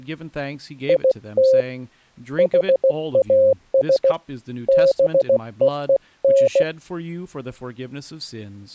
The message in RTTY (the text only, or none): none